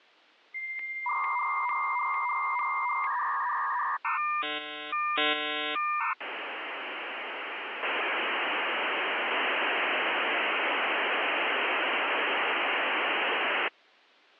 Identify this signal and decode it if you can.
Dial-up modem handshake (V.34 or later), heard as a whistle, warbles, then hiss.